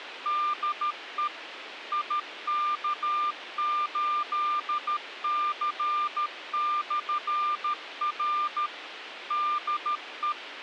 Morse code, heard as a keyed tone, machine-sent, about 13 wpm, 1200 Hz, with radio hiss. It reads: DE IK8C/R DE